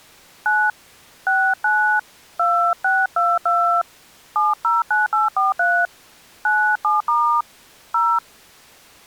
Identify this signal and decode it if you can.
DTMF, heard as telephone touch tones, dialled by hand, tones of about 260 ms. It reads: 9 69 2622 709843 97* 0